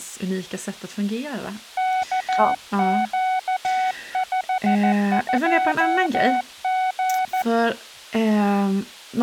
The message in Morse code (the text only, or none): KQ52G